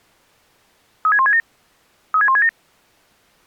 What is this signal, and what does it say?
Five-tone selective call (ZVEI), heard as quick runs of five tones, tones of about 70 ms. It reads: 36167 36167